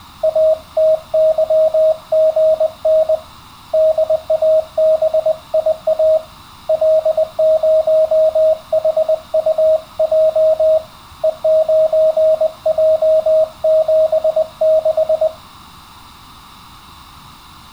Morse code, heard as a keyed tone, hand-sent with a paddle, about 20 wpm, 630 Hz. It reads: ATYGN DABIA L0HUJ E9J76